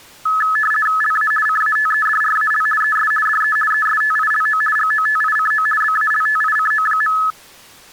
RTTY (50 baud, 450 Hz shift), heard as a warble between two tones, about 1500 Hz centre. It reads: LA CATEDRAL ES DE ESTILO GOTICO BALTICO.